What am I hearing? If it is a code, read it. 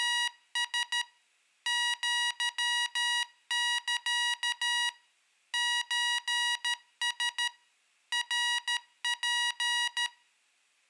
Morse code (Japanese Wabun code), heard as electronic beeps, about 13 wpm, 960 Hz, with room echo. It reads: … アサ ソラ ナツ